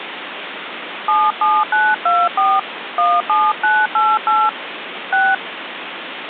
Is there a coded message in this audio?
Yes: DTMF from 1.1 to 5.3 s, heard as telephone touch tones, dialled by hand, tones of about 220 ms, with phone line noise. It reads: 77924 17988 6